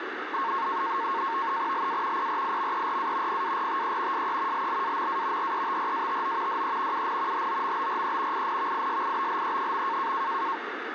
NAVTEX (SITOR-B), 100 baud, 170 Hz shift, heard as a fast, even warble, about 1000 Hz centre, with radio static. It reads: LA PRIMERA PARTE SE LLAMA RETRATO DE UN HOMBRE INVISIBLE.